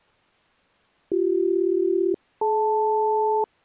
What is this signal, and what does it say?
Aircraft SELCAL, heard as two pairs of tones. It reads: BC-DL